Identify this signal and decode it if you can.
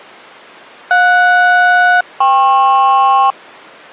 Aircraft SELCAL, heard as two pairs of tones. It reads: JS-KP